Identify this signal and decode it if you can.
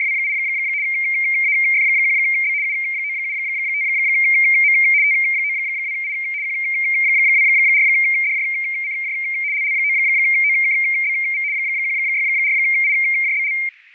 RTTY (75 baud, 170 Hz shift), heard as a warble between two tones, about 2200 Hz centre, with fading and static crashes. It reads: … AF1B U975M T92I Q24DJCJ LL9OKBV 164IJBL